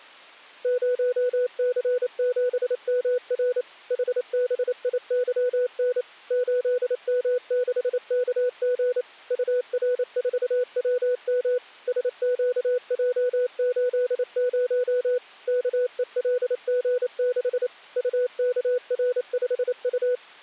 Morse code, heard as a keyed tone, machine-sent, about 28 wpm, 500 Hz. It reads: 0C7MR HBIYN 8M6KG UR4WM SQJ80 KELG6 UKR5U